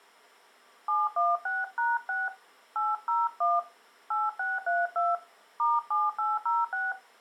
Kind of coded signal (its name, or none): DTMF